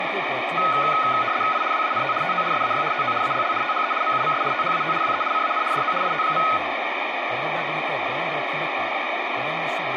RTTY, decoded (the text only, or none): I WANT TO SAY TO ALL THE MUMS THAT WE CAN DO IT.